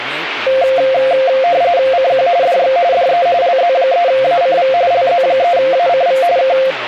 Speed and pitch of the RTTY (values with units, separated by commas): 45.45 baud, 170 Hz shift, 610 Hz centre